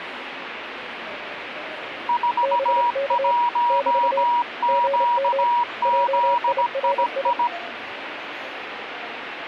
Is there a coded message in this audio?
Yes: Morse code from 2.0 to 7.5 s, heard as two keyed tones, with radio static and the noise of a crowd indoors. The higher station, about 17 wpm, 960 Hz: 41QZII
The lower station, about 28 wpm, 560 Hz: BK <BT> GM JIRI